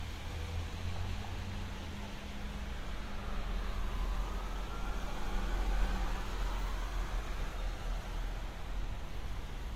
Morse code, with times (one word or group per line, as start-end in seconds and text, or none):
none